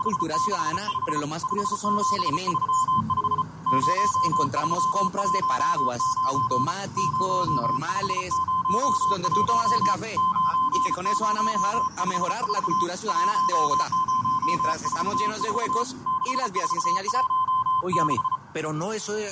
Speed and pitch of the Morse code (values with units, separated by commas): 34 wpm, 1030 Hz